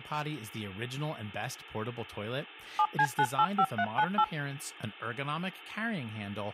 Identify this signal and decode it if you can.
DTMF, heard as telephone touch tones, dialled by machine, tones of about 60 ms, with speech in English. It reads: 7C985398